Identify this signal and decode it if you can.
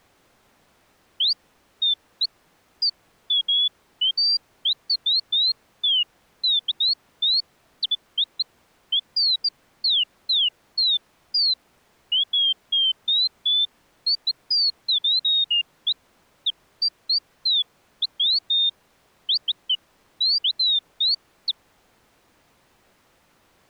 Bird-like chirps. There is no code.